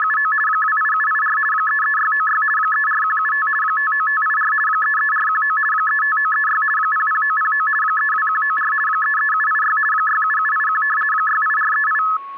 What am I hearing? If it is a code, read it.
RTTY (50 baud, 450 Hz shift), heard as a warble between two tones, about 1500 Hz centre, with static crashes and a steady whistle near 1100 Hz. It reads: … 28784 33696 34175 59584 33419 35936 00909 32194 33786 67781 68438